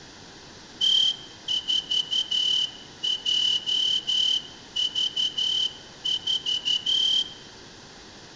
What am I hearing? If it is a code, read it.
Morse code, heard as a whistle, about 12 wpm, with room echo. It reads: T4JV4